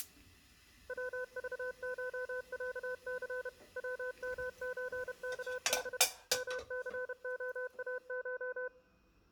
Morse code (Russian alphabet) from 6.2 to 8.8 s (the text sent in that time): МЦОАШ